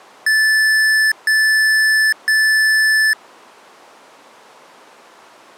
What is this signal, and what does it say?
Beep code, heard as beeps from a small speaker, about 1750 Hz. 3 long. In IBM BIOS tables: keyboard card error.